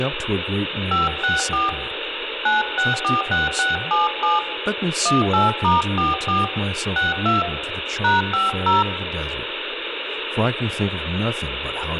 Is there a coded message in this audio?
Yes: DTMF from 0.9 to 8.8 s, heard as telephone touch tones, dialled by hand, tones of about 160 ms, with phone line noise and speech in English. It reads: 564 9646677 18*44 62 #50